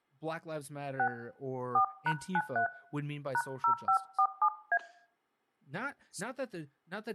DTMF, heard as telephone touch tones, dialled by hand, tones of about 80 ms, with speech in English. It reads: 6 4#93 #0547A